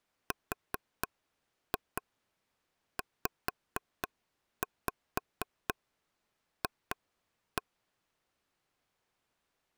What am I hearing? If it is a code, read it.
Tap code, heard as taps on a table, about 4 knocks a second. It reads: RZF